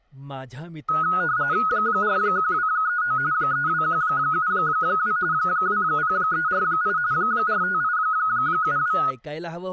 RTTY (45.45 baud, 170 Hz shift), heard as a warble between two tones, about 1360 Hz centre, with speech in Marathi. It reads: 41239 32172 20348 45872